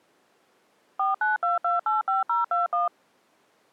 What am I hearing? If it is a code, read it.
DTMF, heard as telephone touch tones, dialled by machine, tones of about 150 ms. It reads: 492285021